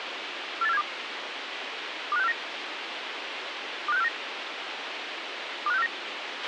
Five-tone selective call (EEA), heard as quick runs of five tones, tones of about 40 ms, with radio hiss and a squelch burst at the end. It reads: 48472 25649 25649 25649